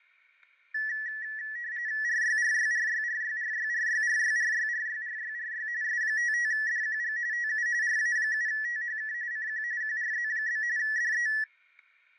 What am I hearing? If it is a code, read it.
RTTY (45.45 baud, 170 Hz shift), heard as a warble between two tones, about 1850 Hz centre, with fading and static crashes. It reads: RYRYRYRYRYRYRYRYRYRYRY S55DQG TU RA7THK CQ QRZ? DE